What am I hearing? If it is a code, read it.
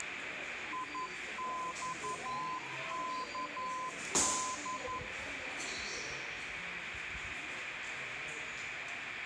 Morse code, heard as a keyed tone, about 11 wpm, 1020 Hz, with radio static, room echo and the noise of a subway station. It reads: IXKD